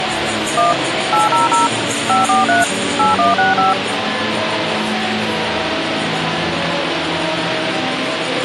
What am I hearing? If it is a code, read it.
DTMF, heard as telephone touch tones, dialled by machine, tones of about 150 ms, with radio hiss. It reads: 1 800 543 8165